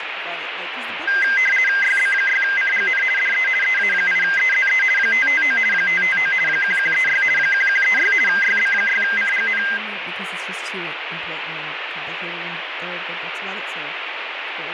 RTTY (50 baud, 450 Hz shift), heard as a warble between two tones, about 1800 Hz centre, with radio static and speech in English. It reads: YB6CGN DE EA8EZE 559 559 1136 1136 YB6CGN